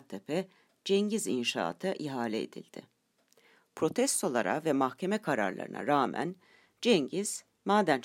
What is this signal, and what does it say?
Speech in Turkish. There is no code.